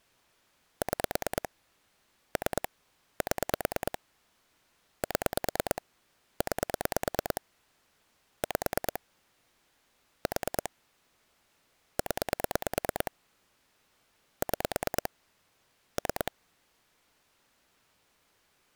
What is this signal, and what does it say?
Pulse dialling, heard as clicks on a phone line, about 9 pulses a second. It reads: 6 3 7 7 9 5 4 0 6 3